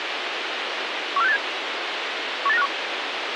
Five-tone selective call (EEA), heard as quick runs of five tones, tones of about 40 ms, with radio hiss. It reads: 14687 18951